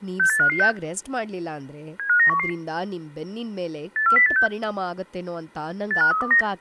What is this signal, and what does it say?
Five-tone selective call (CCIR), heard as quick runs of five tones, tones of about 100 ms, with speech in Kannada. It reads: 68556 75911 84086 85329